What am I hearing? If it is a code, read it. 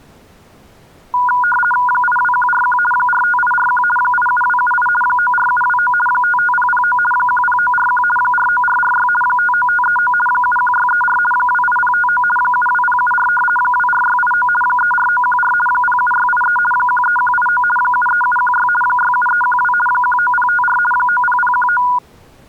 RTTY (50 baud, 450 Hz shift), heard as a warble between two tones, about 1210 Hz centre. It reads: 82141 45841 87278 94729 55009 10941 49446 59539 71634 28059 72074 24689 34914 07683 13189 73716 67312 19054 90019